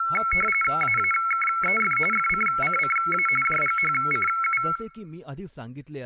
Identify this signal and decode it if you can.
RTTY (45.45 baud, 850 Hz shift), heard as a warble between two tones, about 1750 Hz centre, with speech in Marathi. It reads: AAKEF FCCCA JGHCU